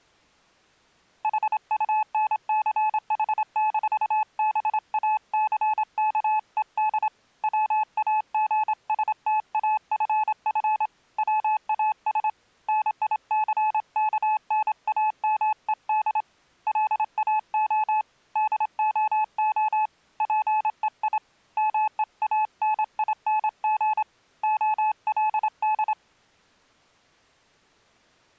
Morse code, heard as a keyed tone, hand-sent with a straight key, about 26 wpm, 860 Hz. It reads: HUNCH-BACKED WAGSTAFF WAS NICKNAMED LAO DOO PEI MEANING OLD